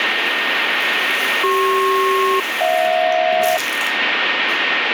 Aircraft SELCAL, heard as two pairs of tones, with radio static and the noise of a restroom. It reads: CP-HJ